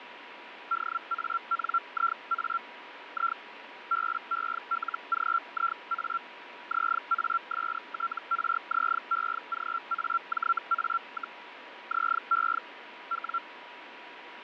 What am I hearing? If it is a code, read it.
Hellschreiber (Feld-Hell, 122.5 baud), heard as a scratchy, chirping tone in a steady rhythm, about 1360 Hz, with radio static and a steady whistle near 970 Hz. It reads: DANIA I BELGIA ZASTRZEGAJA, ZE W